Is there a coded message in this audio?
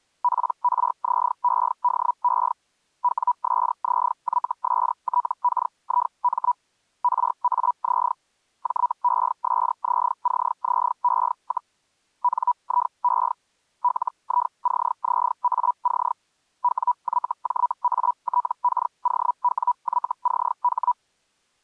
Yes: Hellschreiber (Feld-Hell, 122.5 baud) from 0.2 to 20.9 s, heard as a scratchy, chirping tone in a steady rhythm, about 980 Hz. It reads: PRZEDE WSZYSTKIM RAZ JESZCZE, NIE LICZAC WYJATKOWYCH